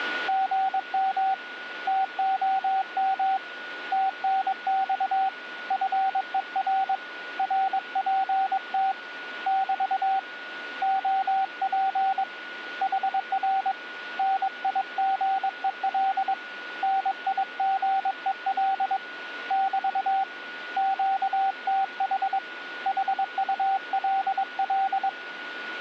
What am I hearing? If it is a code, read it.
Morse code, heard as a keyed tone, hand-sent with a paddle, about 22 wpm, 770 Hz, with a steady whistle near 1450 Hz. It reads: GM TOM TNX FER RPT <BT> OP HR NIGEL NIGEL <BT> QTH HULL